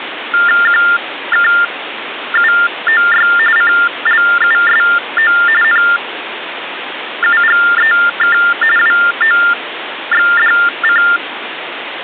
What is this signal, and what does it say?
TTY/TDD text telephone tones (45.45 baud Baudot), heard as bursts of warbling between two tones, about 400 Hz shift, 1600 Hz centre, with phone line noise. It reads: QKUOY CLUSO NUGEK WOXDC